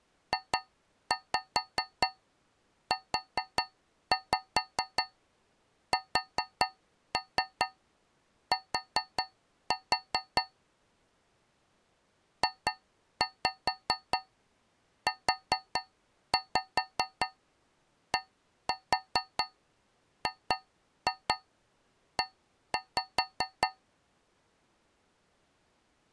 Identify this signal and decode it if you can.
Tap code, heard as taps on a metal pipe, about 4 knocks a second. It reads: JUST JUDGE